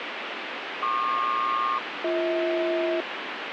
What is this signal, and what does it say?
Aircraft SELCAL, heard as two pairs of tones, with radio static. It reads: PQ-BH